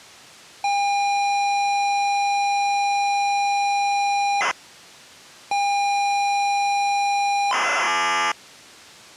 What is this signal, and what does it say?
ZX Spectrum tape loading, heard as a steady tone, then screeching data.